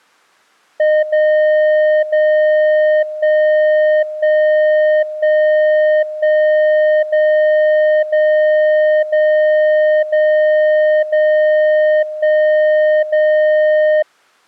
Radio time signal (DCF77), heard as a tone whose level steps once a second, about 610 Hz. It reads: 0 0 1 1 1 1 0 0 0 0 0 1 0